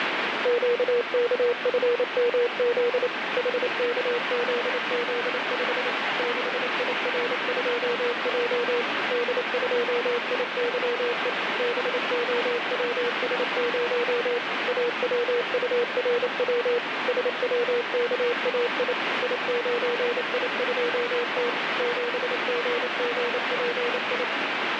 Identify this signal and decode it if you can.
Morse code, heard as a keyed tone, machine-sent, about 28 wpm, 480 Hz, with heavy radio static. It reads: QKFMZ HKZZ5 6IR2J D2IYE BOWS0 AWURW SWKAI I9I2T 7GGPI